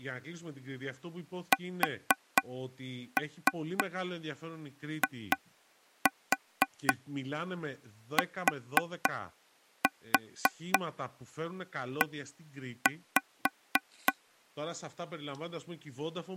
Tap code, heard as taps on a table, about 3 knocks a second, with speech in Greek. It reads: SITE